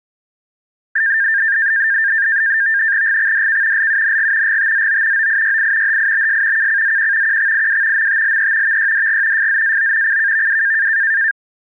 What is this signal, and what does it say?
NAVTEX (SITOR-B), 100 baud, 170 Hz shift, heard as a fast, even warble, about 1700 Hz centre. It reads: GXDK LUNG GTZO OIYI HIBS KCZQ QXIW MTLE VYDG FZAO CKVW